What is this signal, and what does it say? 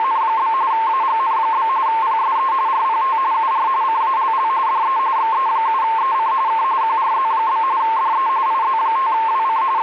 RTTY (45.45 baud, 170 Hz shift), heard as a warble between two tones, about 980 Hz centre, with radio static. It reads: … AGN? PSE RPT UR CALL DE XE7EC K QRZ? DE IZ5WC …